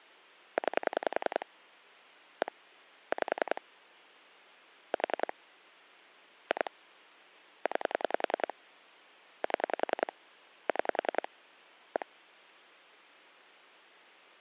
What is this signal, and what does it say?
Pulse dialling, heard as clicks on a phone line, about 10 pulses a second. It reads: 9 1 5 4 2 9 7 6 1